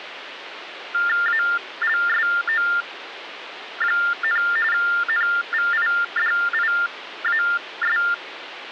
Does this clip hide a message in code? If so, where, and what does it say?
Yes: TTY/TDD text telephone tones (45.45 baud Baudot) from 0.9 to 8.1 s, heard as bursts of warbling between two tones, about 400 Hz shift, 1600 Hz centre, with phone line noise. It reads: ALSO, NVIDIAS